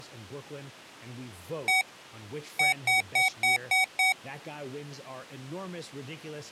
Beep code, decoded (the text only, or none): 1-6